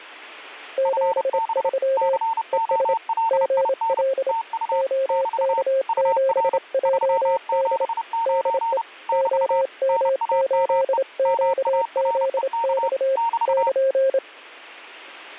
Morse code, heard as two keyed tones. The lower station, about 27 wpm, 530 Hz: 73 ES GL OK7JD DE OM8QZX <KN>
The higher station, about 30 wpm, 910 Hz: FB COLIN TU <BT> UR 379 <BT> NAME MAREK <BT>